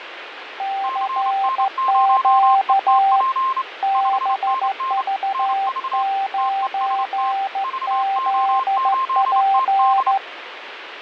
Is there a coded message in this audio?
Yes: Morse code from 0.5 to 10.2 s, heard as two keyed tones, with radio static and fading. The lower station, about 14 wpm, 780 Hz: CQ BV9ZP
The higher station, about 28 wpm, 1060 Hz: CN0ETP 5NN NV TEST VO8TD